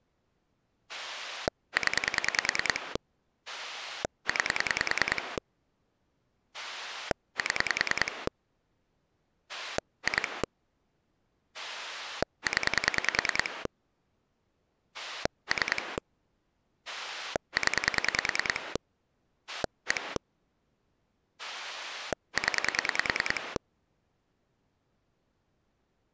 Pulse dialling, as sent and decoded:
10 / 9 / 7 / 2 / 10 / 3 / 10 / 1 / 10
0 9 7 2 0 3 0 1 0

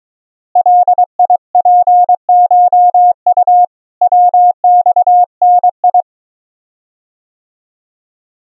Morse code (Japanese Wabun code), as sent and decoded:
.-.. .. .--. ---- ..- / .-- -..- -. ..
ガツコウ ヤマダ

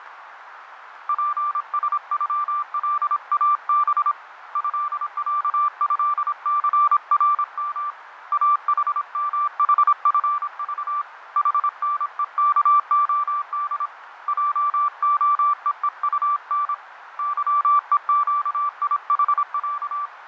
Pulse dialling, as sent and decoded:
none

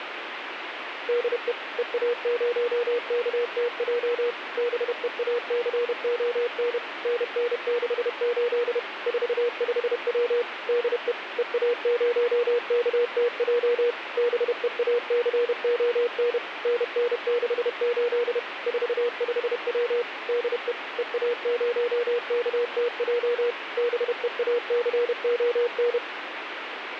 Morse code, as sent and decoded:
-.. . / . .- ----- -.- - .--- / -... . .- -.-. --- -. / -. -. -.... ---.. / ....- ..... .-- / -.. . / . .- ----- -.- - .--- / -... . .- -.-. --- -. / -. -. -.... ---.. / ....- ..... .-- / -.. . / . .- ----- -.- - .--- / -... . .- -.-. --- -.
DE EA0KTJ BEACON NN68 45W DE EA0KTJ BEACON NN68 45W DE EA0KTJ BEACON

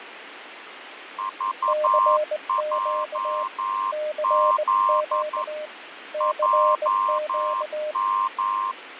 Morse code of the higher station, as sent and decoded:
...- .--- --.. / .--- --
VJZ JM

